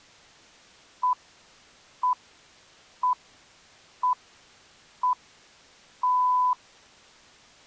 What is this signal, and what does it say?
Radio time signal (six pips, as the Greenwich Time Signal), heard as pips.